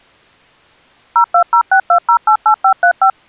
DTMF, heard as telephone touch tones, dialled by machine, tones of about 90 ms. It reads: 02062088535